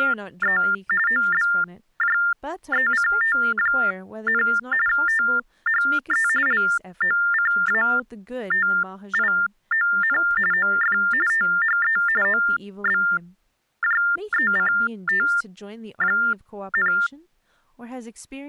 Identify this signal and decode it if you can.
TTY/TDD text telephone tones (45.45 baud Baudot), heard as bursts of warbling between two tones, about 400 Hz shift, 1600 Hz centre, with speech in English. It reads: … OBJECT, THE LOCATION OF THE OBJECT,